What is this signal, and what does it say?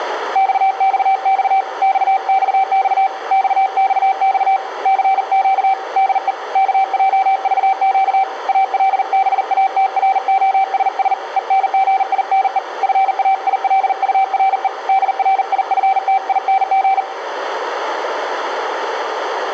Morse code, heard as a keyed tone, hand-sent with a paddle, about 40 wpm, 770 Hz, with radio static and room echo. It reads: XXX XXX XXX CQ DE KJVQ ALBATROSS ENGINE FAILURE DRIFTING